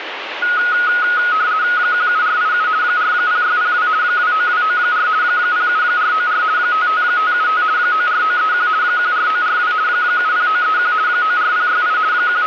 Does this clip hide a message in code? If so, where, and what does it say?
Yes: RTTY (50 baud, 170 Hz shift) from 0.4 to 12.5 s, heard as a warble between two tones, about 1360 Hz centre, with radio static. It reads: 17487 40602 29294 07494 55575 94931 14942 70931 94068 …